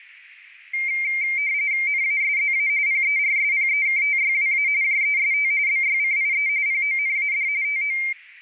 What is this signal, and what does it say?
RTTY (45.45 baud, 170 Hz shift), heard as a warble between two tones, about 2200 Hz centre, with radio static and a narrow filter. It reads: NASZA PERSPEKTYWA JEST BYCIE PONAD TO